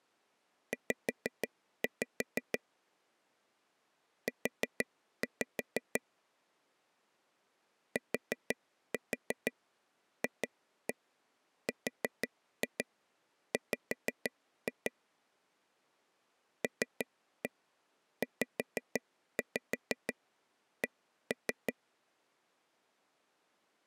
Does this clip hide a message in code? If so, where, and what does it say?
Yes: tap code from 0.7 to 21.7 s, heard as taps on a table, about 6 knocks a second. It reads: Z U TFRW LZC